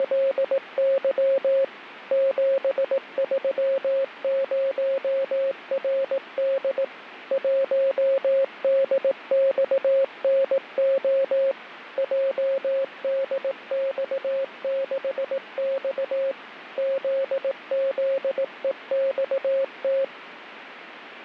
Morse code, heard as a keyed tone, machine-sent, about 18 wpm, 540 Hz, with radio static. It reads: … 730RD 1DXNO JDX6X ZZEXT